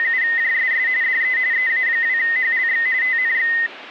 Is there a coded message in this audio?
Yes: RTTY (45.45 baud, 170 Hz shift) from 0.0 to 3.7 s, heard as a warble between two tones, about 1950 Hz centre. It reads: … DE EA2HLX TNX